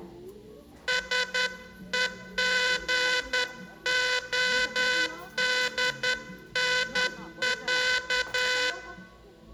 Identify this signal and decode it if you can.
Morse code (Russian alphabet), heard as a buzzer, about 10 wpm, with the noise of a crowd indoors. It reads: СЕГОДНЯ